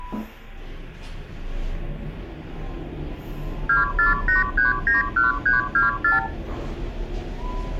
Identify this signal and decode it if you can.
Multi-frequency trunk signalling (R2, with the far end's replies), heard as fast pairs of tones, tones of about 150 ms, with room echo and the noise inside a lift. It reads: 248391324